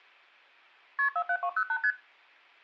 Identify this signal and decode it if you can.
Multi-frequency trunk signalling (R1, as on North American trunks), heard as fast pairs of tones, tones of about 70 ms. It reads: KP 47208 ST